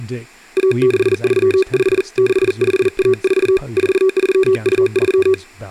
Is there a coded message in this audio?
Yes: Morse code (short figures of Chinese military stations) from 0.5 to 5.4 s, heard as a keyed tone, hand-sent with a paddle, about 40 wpm, 380 Hz, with speech in English. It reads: 1635 6514 4323